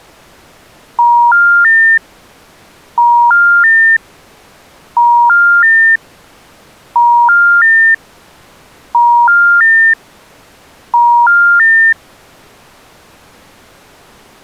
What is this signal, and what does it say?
Telephone call progress tone (ITU plan), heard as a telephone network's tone, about 950, 1400, 1800 Hz. Special information tone.